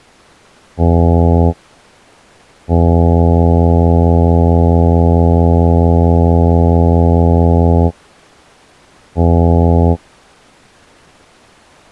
Ship horn signal, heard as a ship's horn, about 80 Hz. 1 short, 1 long, 1 short. At sea: a vessel at anchor warns of its position.